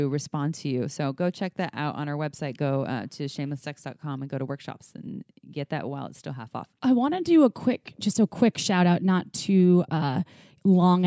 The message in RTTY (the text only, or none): none